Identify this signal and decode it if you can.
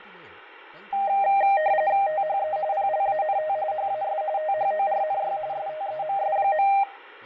RTTY (45.45 baud, 170 Hz shift), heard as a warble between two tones, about 710 Hz centre, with fading and speech in Telugu. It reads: THE PLANT HAS THORNY STEMS.